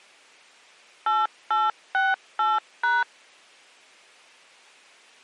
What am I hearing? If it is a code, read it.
DTMF, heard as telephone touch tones, dialled by machine, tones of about 190 ms. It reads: 8868#